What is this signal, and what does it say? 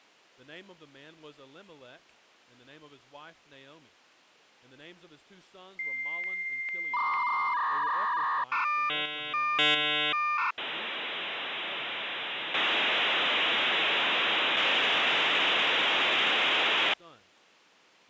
Dial-up modem handshake (V.34 or later), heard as a whistle, warbles, then hiss.